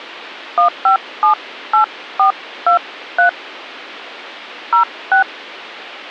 DTMF, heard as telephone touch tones, dialled by hand, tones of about 110 ms. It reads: 1578423 06